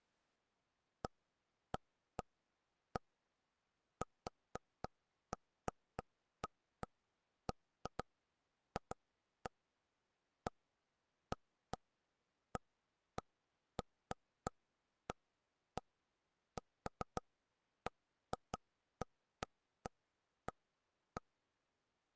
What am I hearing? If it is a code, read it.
Irregular taps on a table. There is no code.